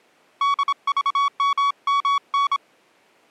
Morse code, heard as a keyed tone, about 26 wpm, 1130 Hz. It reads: DVMMN